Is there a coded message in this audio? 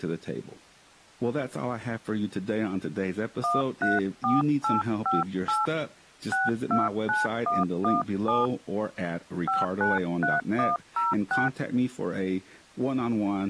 Yes: DTMF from 3.4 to 11.5 s, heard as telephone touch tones, dialled by hand, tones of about 170 ms, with speech in English. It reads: 134858 629117 593106